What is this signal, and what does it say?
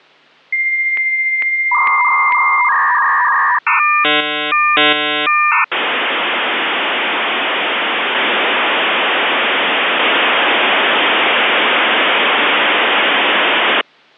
Dial-up modem handshake (V.34 or later), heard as a whistle, warbles, then hiss.